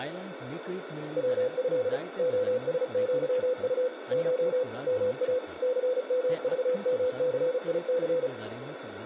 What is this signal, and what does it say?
Morse code (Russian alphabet), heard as a keyed tone, machine-sent, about 35 wpm, 500 Hz, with radio static, room echo and speech in Goan Konkani. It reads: ВЭ ОСЪУ Ш МА ЦМЖМЦИЦ